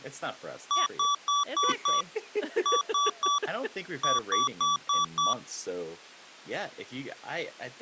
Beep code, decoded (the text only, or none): 5-3-5